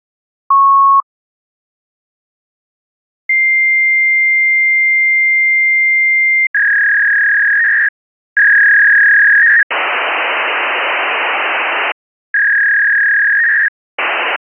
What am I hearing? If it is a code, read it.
Fax machine handshake, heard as a beep, a long tone, a warble and hiss.